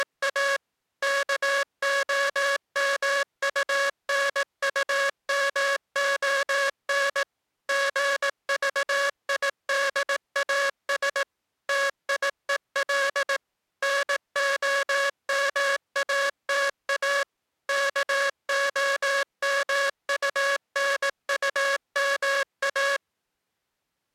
Morse code, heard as a buzzer, machine-sent, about 18 wpm. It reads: … KOMUNUMON GVIDAS TIEL NOMATA KOMUNUMA